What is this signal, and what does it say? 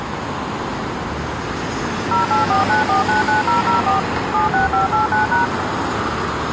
DTMF, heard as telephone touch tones, dialled by machine, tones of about 140 ms, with street noise. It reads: 0849499004 76589#